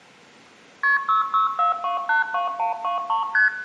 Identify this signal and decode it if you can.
Multi-frequency trunk signalling (R1, as on North American trunks), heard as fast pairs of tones, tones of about 140 ms, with room echo. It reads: KP 664282123 ST